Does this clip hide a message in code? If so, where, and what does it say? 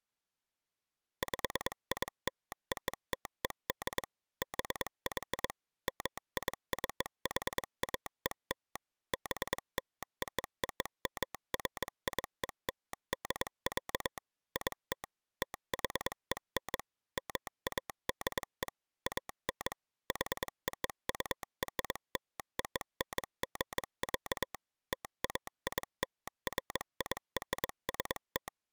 Yes: Morse code (American railroad code) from 1.2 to 28.5 s, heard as a telegraph sounder, machine-sent. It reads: PILOTED BY MICHAEL BLOOMFIELD, IT THEN MADE AN HOURLONG, TAILFIRST